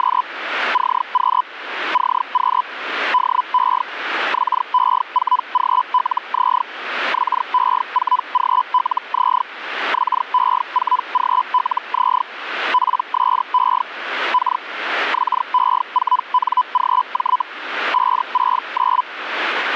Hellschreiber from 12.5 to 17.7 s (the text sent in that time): PSE K XE4NGJ